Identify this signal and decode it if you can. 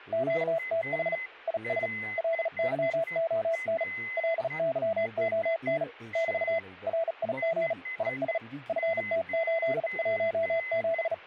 Morse code, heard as a keyed tone, hand-sent with a bug key, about 37 wpm, 660 Hz, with a weaker station near 2040 Hz and speech in Manipuri. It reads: QTH IS LYON LYON <BT> RIG IS FT817